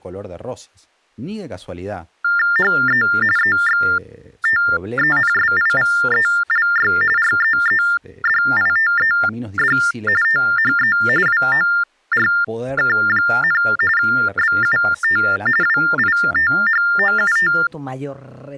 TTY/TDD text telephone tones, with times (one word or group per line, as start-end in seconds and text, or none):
2.6-3.0 HE
3.4-6.9 EXTENSIVELY
7.2-9.8 REEDITED
10.2-11.0 THE
11.3-13.6 WORK,
14.0-15.2 BUT
15.6-17.5 WITHOUT